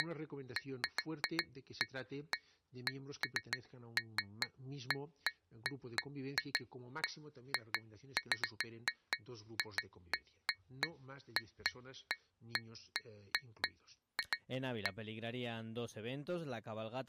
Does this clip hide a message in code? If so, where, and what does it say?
No, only irregular taps on glass.